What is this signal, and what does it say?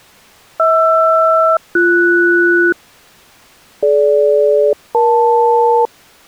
Aircraft SELCAL, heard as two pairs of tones. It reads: HR-BS DG-EL